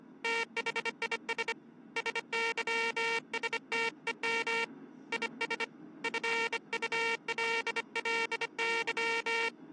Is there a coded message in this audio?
Yes: Morse code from 0.2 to 9.5 s, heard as a buzzer, hand-sent with a bug key, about 25 wpm, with the noise inside a subway train. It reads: THIS SYSTEM IS FULLY